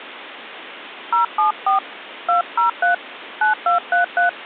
DTMF, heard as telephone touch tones, dialled by hand, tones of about 130 ms, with phone line noise. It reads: 074 203 9233